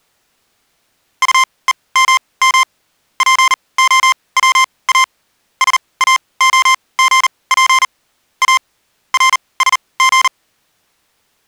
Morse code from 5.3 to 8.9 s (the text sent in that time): SAOGP A